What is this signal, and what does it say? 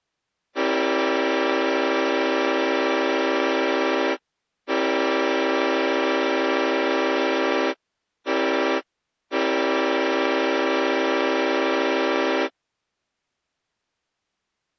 Train horn signal, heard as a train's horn. 2 long, 1 short, 1 long. On North American railways: approaching a public crossing.